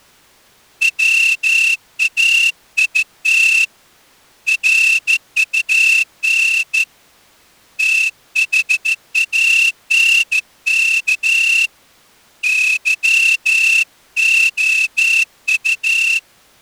Morse code, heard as a whistle, hand-sent with a straight key, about 14 wpm. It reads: WAIT RUN THANK YOU